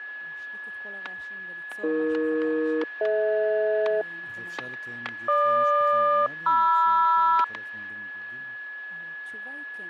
Aircraft SELCAL, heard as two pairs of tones, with static crashes, a steady whistle near 1700 Hz and speech in Hebrew. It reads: AE-DH GQ-MR